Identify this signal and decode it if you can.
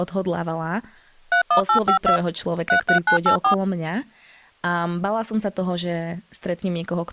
DTMF, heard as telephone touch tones, dialled by machine, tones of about 100 ms, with speech in Slovak. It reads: 31852 33984